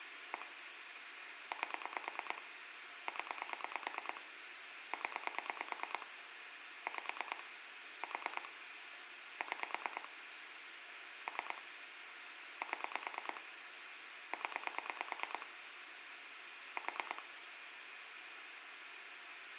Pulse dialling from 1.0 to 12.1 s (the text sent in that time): 8 0 0 5 4 6 3